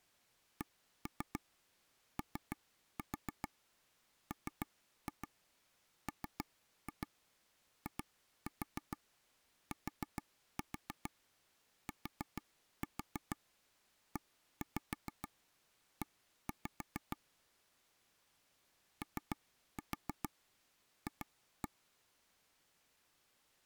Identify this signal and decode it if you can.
Tap code, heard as taps on a table, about 6 knocks a second. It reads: COMMITTEE OF